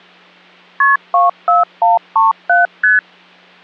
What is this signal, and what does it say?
Multi-frequency trunk signalling (R1, as on North American trunks), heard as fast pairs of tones, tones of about 160 ms. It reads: KP 24137 ST